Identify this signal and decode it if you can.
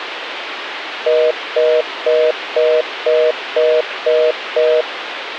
Telephone call progress tone (North American plan), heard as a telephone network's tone, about 480, 620 Hz, 0.25 s on and 0.25 s off, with phone line noise. Congestion tone.